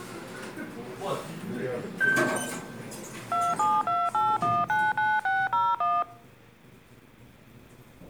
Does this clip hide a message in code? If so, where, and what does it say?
Yes: DTMF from 3.3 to 6.0 s, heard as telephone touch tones, dialled by machine, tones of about 220 ms, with the noise inside a lift. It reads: 2728199601